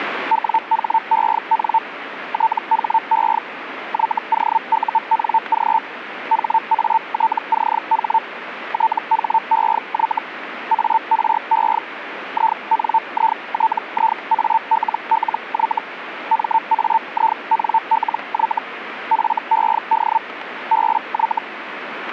Hellschreiber (Feld-Hell, 122.5 baud), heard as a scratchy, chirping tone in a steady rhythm, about 900 Hz, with radio static. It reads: WHEN THE YOUNG HATCH THEY ARE INITIALLY MAINLY FED BY